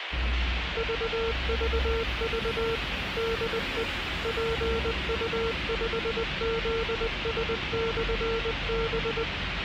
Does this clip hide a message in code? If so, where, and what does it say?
Yes: Morse code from 0.7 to 9.3 s, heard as a keyed tone, machine-sent, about 20 wpm, 460 Hz, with radio hiss and street noise. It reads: VVV DE PU5ZS/B